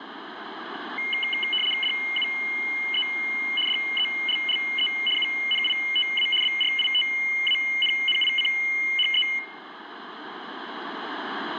RTTY (75 baud, 850 Hz shift), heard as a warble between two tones, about 2550 Hz centre, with radio static. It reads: DUE DELLE UNITA BRITANNICHE